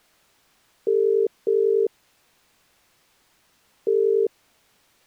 Telephone call progress tone (as in the UK, Ireland, Australia and similar networks), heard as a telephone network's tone, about 400, 450 Hz. Ringback tone.